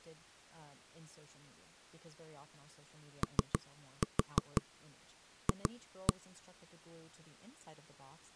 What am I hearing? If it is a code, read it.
Tap code, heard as knocks on wood, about 6 knocks a second, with speech in English. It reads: OF